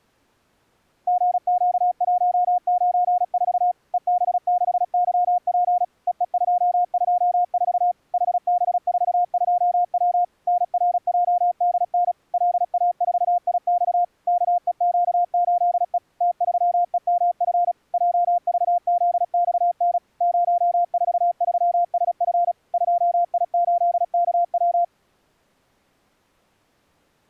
Morse code, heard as a keyed tone, machine-sent, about 36 wpm, 710 Hz. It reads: GQ194 EB6YP EE224 HB42W NRJDN LA4IX KEQ8E T3EMF JVZXN 043SF 2I8KW